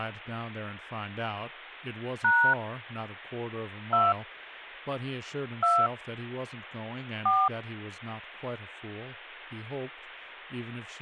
DTMF, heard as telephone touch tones, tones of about 220 ms, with speech in English. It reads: # 2 2 4